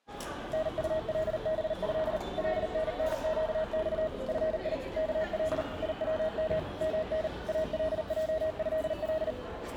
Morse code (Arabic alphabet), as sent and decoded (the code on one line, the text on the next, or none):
-. ..- .-.. -... ..-.. / .-.. -. -. --.- -..- / ..-. .. / -.- .-.. / .. .-- -- / -- -. / .- .-.. .--- ..-.. .-..
نطلبه لننقص في كل يوم من الجهل